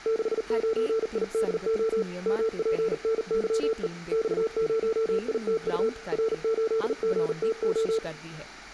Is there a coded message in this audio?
Yes: Morse code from 0.0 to 8.0 s, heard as a keyed tone, hand-sent with a paddle, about 39 wpm, 450 Hz, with room echo and speech in Punjabi. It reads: 69IDO MPNYE X0ITU R8GTO